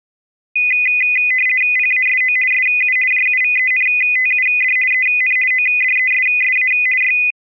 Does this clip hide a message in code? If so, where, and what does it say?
Yes: RTTY (50 baud, 450 Hz shift) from 0.6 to 7.3 s, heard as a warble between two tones, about 2250 Hz centre. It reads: PASO SU JUVENTUD EN ODESSA Y